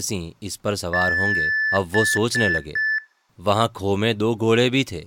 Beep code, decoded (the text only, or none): 1 long, 3 short